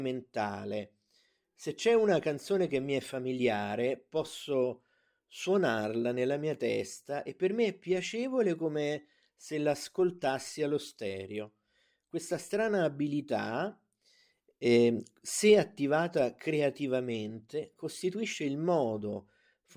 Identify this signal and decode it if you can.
Speech in Italian. There is no code.